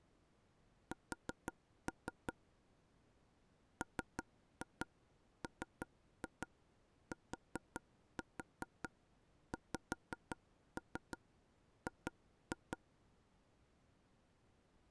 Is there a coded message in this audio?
Yes: tap code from 0.9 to 12.8 s, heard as taps on a table, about 5 knocks a second. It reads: S MMTXG